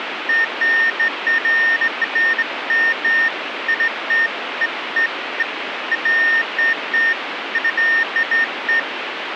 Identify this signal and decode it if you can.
Beeps of irregular length, with radio hiss. There is no code.